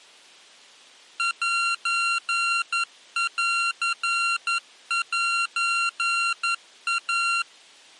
Morse code (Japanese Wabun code), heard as electronic beeps, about 11 wpm, 1380 Hz. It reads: センセイ